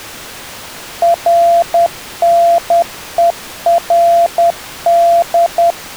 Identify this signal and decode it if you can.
Morse code, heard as a keyed tone, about 10 wpm, 680 Hz. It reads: RNERD